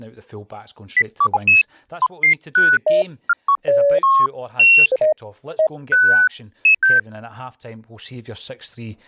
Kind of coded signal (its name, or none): none